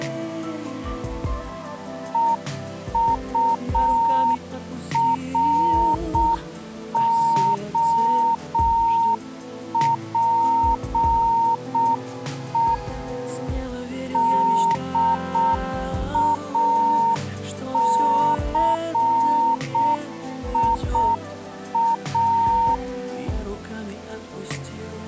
Morse code, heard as a keyed tone, machine-sent, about 6 wpm, 920 Hz. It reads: EUROPE DACIA